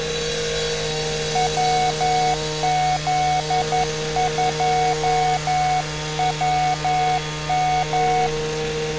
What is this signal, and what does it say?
Morse code, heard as a keyed tone, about 11 wpm, 740 Hz, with street noise. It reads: WZ2WM